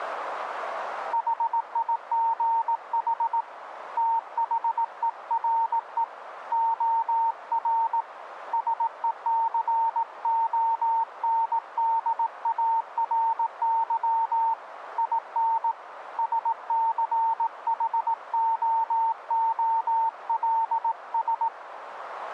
Morse code, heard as a keyed tone, hand-sent with a paddle, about 18 wpm, 910 Hz, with radio static. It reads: HIGH THERE OR SECONDARY IN SCHOOLS